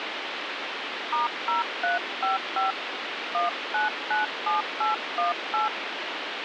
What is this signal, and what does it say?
DTMF, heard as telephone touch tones, dialled by hand, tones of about 140 ms, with phone line noise. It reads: *0355 1997818